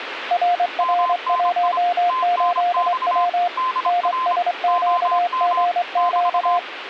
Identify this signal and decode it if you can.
Morse code, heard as two keyed tones, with radio static. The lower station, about 23 wpm, 710 Hz: RR18W NSQGQ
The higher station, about 26 wpm, 1030 Hz: MNI TNX DR OM <BT>